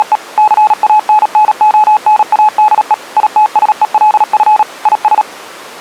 Morse code, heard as a keyed tone, machine-sent, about 37 wpm, 850 Hz. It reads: … CANNONADE ITSELF IS